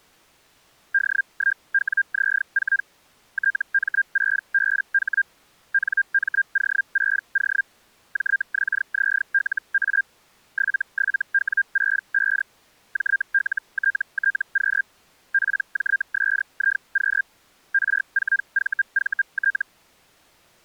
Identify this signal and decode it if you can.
Hellschreiber (Feld-Hell, 122.5 baud), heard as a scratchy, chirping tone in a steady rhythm, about 1600 Hz. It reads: D1WZ4 TM6BH NMO6O JXZLA 77W65 JLTTQ PJSIQ R4VVT